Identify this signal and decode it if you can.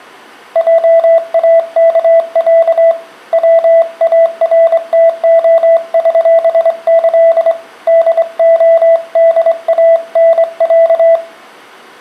Morse code (with Polish letters), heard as a keyed tone, hand-sent with a straight key, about 24 wpm, 660 Hz. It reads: JAKĄ WARTOŚĆ DODANĄ